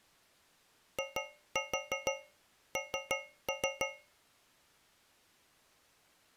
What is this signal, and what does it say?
Tap code, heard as taps on a metal pipe, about 6 knocks a second. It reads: IN